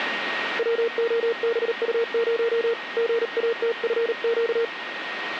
Morse code, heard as a keyed tone, hand-sent with a paddle, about 38 wpm, 460 Hz, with radio static and a steady whistle near 1870 Hz. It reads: WOBU0 GATFQ